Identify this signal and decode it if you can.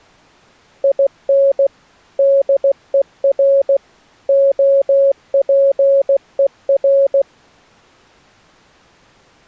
Morse code, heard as a keyed tone, machine-sent, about 16 wpm, 550 Hz. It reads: IN DER OPER